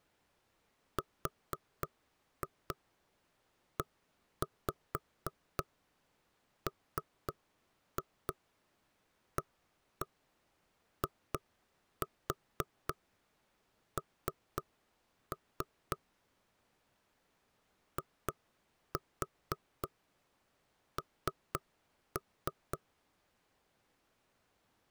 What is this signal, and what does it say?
Tap code, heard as knocks on wood, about 4 knocks a second. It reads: REMAIN IN